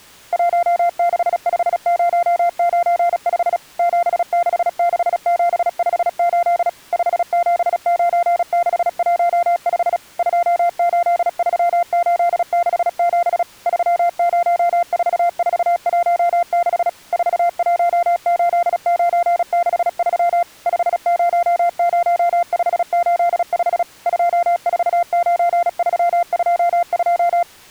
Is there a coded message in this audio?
Yes: Morse code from 0.3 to 27.5 s, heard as a keyed tone, machine-sent, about 36 wpm, 690 Hz. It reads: 165095 766758 579615 283867 304416 418963 500585 249322